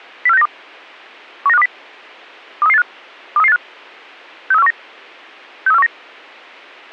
Five-tone selective call (EEA), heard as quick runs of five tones, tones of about 40 ms, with a squelch burst at the end. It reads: 04692 19520 23385 23385 63419 63419